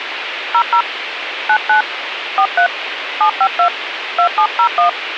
DTMF, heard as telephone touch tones, dialled by hand, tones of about 90 ms, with phone line noise. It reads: 00 99 43 752 2701